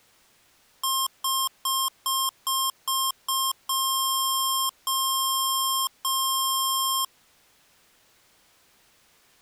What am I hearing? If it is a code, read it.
Beep code, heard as beeps from a small speaker, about 1070 Hz. 7 short, 3 long.